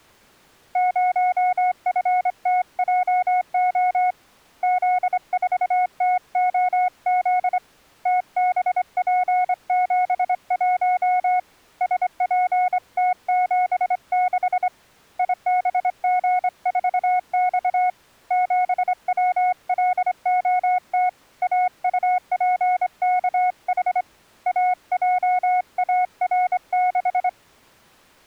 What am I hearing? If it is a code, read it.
Morse code, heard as a keyed tone, hand-sent with a straight key, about 25 wpm, 730 Hz. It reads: 0FTJO Z4TOZ TBP71 SPT76 IBG4X 7WLOT AUPKH AJAR6